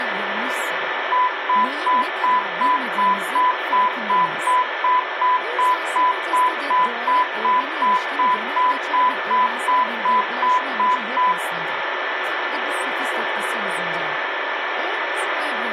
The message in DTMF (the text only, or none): none